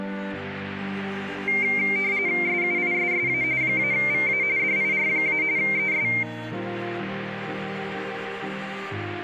RTTY (45.45 baud, 170 Hz shift), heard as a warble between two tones, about 2200 Hz centre. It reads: SUISSA -VA DIR- ES